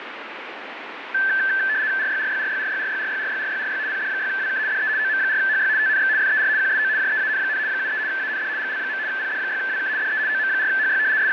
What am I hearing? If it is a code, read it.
RTTY (75 baud, 170 Hz shift), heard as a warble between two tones, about 1650 Hz centre, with radio static. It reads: RYRYRYRYRYRYRYRYRY PD6WK DE OM4HY TNX FER QSO JEAN, 73 AND GL. PD6WK DE OM4HY …